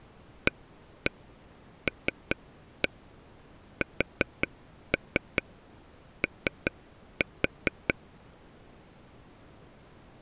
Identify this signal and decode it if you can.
Tap code, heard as taps on a table, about 5 knocks a second. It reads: ALSO